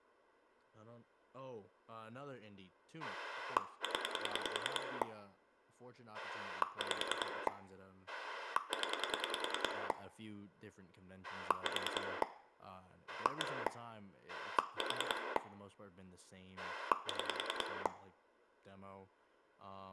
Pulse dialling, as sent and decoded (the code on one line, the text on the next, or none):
10 / 5 / 10 / 4 / 1 / 4 / 6
0 5 0 4 1 4 6